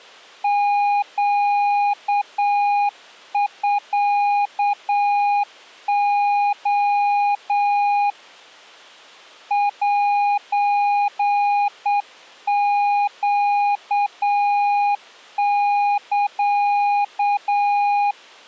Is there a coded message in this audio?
Yes: Morse code (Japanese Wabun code) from 0.4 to 18.2 s, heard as a keyed tone, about 8 wpm, 820 Hz. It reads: ネミレ セネサ